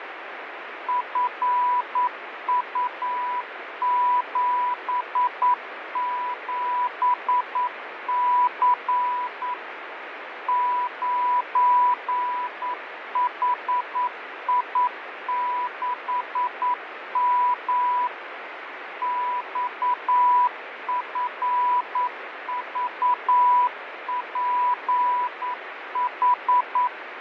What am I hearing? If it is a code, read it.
Morse code, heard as a keyed tone, machine-sent, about 9 wpm, 990 Hz, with radio static and fading. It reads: FU77C 9HI6M XFVPH